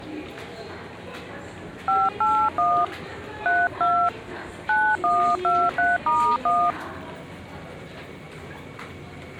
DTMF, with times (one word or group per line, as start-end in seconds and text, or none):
1.9-2.8 581
3.5-4.1 32
4.7-6.7 9123*1